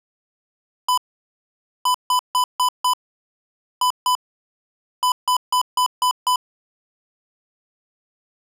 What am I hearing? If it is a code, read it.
Beep code, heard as beeps from a small speaker, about 1000 Hz. 1-5-2-6.